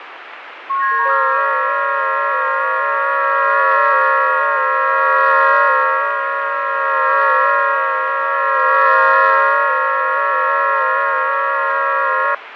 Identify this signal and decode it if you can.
FT8 (several signals at once), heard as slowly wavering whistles, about 6.25 baud, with radio static and fading.